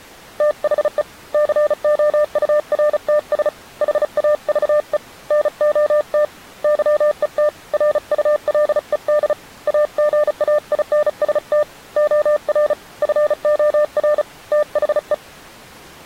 Morse code, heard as a keyed tone, hand-sent with a paddle, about 35 wpm, 600 Hz. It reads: THE COURTS HAVE NOT YET RULED AGAINST OR FOR THE